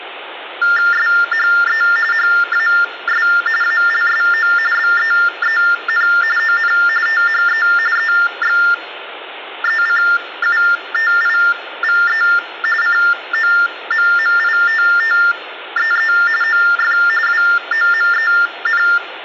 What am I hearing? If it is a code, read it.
TTY/TDD text telephone tones (45.45 baud Baudot), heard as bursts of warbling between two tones, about 400 Hz shift, 1600 Hz centre, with phone line noise and room echo. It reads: SHE HAS ALSO BEEN ON THE EXECUTIVE COMMITTEE OF WOMEN